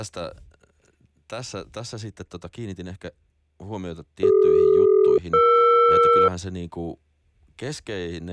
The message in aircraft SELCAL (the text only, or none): CD-ER